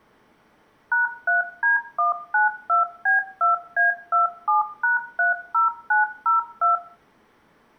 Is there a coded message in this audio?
Yes: DTMF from 0.9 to 6.8 s, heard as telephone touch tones, dialled by machine, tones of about 140 ms, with room echo. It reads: #3D192B2A27#30902